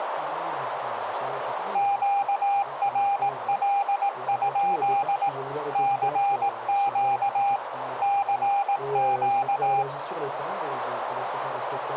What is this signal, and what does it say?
Morse code, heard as a keyed tone, machine-sent, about 18 wpm, 800 Hz, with radio static and a narrow filter. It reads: QRL? CQ CQ